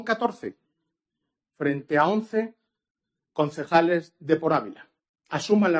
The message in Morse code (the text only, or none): none